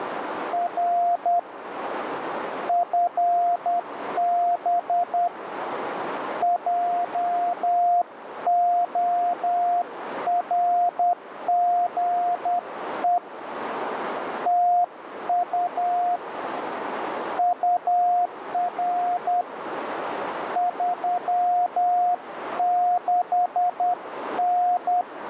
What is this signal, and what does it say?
Morse code, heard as a keyed tone, hand-sent with a paddle, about 10 wpm, 710 Hz, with radio static and a narrow filter. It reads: R FB JORGE TU UR 36N